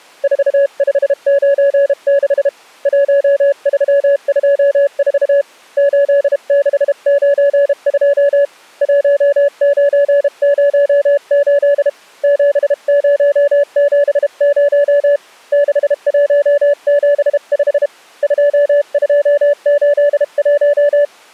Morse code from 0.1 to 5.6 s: 4596 1324

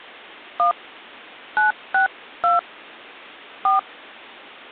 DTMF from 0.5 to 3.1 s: 1 962

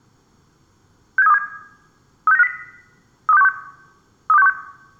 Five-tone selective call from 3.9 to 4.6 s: 32616

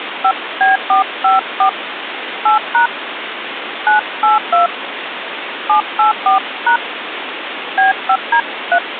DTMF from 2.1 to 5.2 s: 8# 982

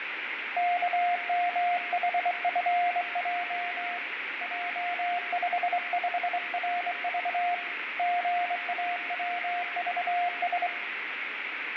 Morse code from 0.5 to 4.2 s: KMHFJ

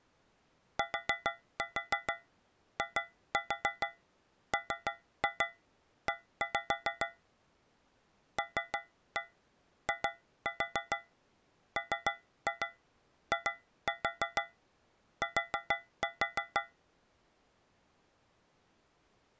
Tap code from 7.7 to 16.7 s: LIMIT

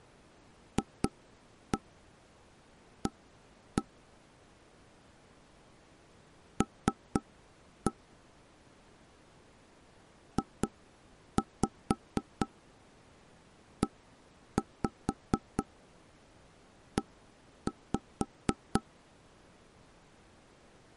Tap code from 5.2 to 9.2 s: L

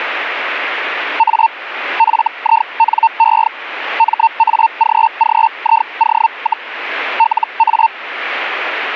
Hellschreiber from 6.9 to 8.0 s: LA

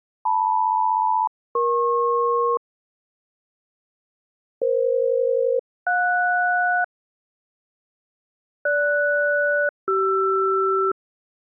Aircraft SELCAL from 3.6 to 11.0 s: EF-JS GS-CR

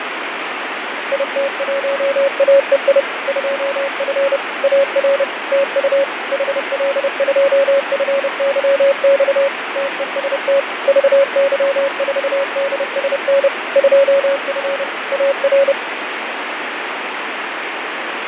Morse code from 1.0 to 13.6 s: IT1AEI 2F AR TU HL2FYX TEST VY4DSN

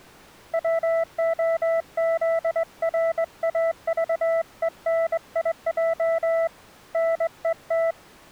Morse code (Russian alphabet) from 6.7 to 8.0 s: НЕТ

